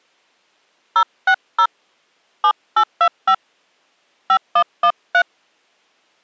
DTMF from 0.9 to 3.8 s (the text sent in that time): 060 7825